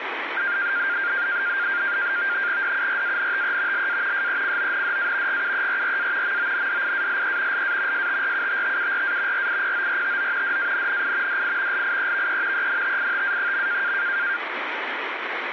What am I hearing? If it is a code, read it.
NAVTEX (SITOR-B), 100 baud, 170 Hz shift, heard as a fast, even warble, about 1500 Hz centre, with radio static. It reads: DURANTE LA SECONDA GUERRA MONDIALE LA STRUTTURA RIPORTO DANNI DI LIEVE ENTITA.